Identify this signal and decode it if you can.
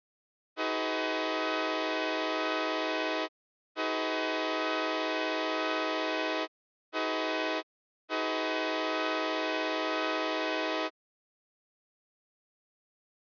Train horn signal, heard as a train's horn. 2 long, 1 short, 1 long. On North American railways: approaching a public crossing.